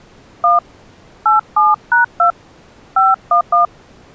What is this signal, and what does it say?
DTMF, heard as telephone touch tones, dialled by hand, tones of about 160 ms. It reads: 1 87#2 511